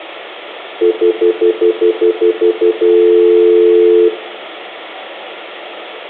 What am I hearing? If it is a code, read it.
Telephone call progress tone (North American plan), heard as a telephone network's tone, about 350, 440 Hz, 0.1 s on and 0.1 s off, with phone line noise and room echo. Stutter dial tone.